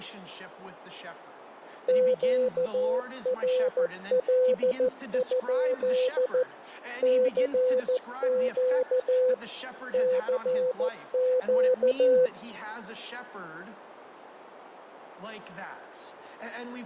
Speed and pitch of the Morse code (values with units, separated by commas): 14 wpm, 510 Hz